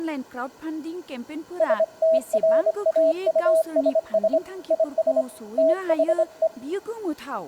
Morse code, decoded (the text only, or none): STRAUSS IS THE